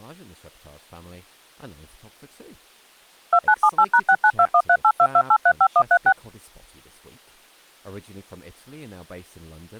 DTMF, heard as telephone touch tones, dialled by machine, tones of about 60 ms, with speech in English. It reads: 2978#69213822835136